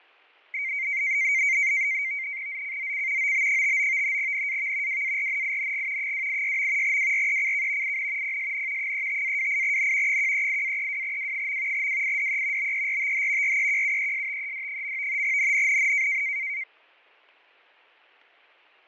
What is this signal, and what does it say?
NAVTEX (SITOR-B), 100 baud, 170 Hz shift, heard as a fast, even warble, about 2200 Hz centre, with fading. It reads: ZCZC OB59 NAV WARNING 286. WRECK IN PSN 35-28N 138-32W. WIDE BERTH REQUESTED. NNNN